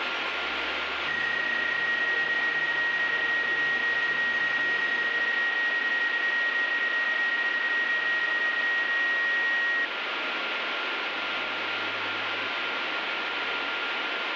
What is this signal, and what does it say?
PSK31 (31.25 baud), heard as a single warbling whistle, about 1900 Hz, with radio static and a steady whistle near 1400 Hz.